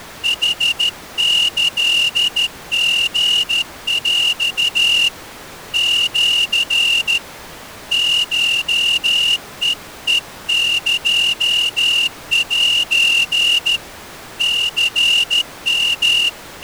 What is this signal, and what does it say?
Morse code (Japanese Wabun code), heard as a whistle, hand-sent with a straight key, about 13 wpm. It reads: ヌキリヰ シ コヘヘエセ …